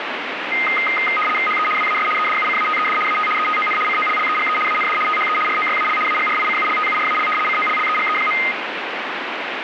RTTY (75 baud, 850 Hz shift), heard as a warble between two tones, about 1650 Hz centre, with radio static. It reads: HE WAS EDUCATED AT ETON COLLEGE AND THE ROYAL AGRICULTURAL COLLEGE.